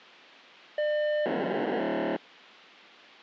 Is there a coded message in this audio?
Yes: POCSAG pager data (1200 baud) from 0.8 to 2.2 s, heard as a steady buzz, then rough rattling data.